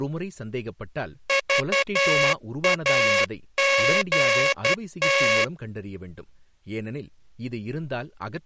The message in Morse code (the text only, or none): VAGT